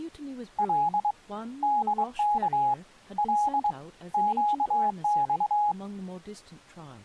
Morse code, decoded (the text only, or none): L DK L QX